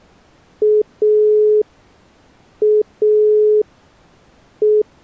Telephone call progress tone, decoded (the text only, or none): dial tone